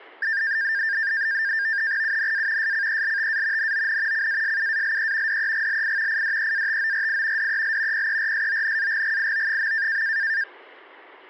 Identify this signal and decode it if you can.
NAVTEX (SITOR-B), 100 baud, 170 Hz shift, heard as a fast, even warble, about 1700 Hz centre. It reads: UNA SCELTA NON CASUALE DEGLI IDEATORI DEL PERSONAGGIO.